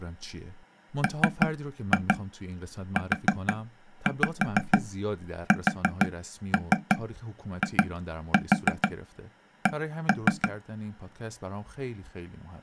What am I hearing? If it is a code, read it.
Tap code, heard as taps on a table, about 6 knocks a second, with speech in Persian. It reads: MUSIC